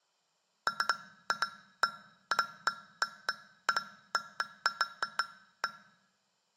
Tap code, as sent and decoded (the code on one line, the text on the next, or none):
none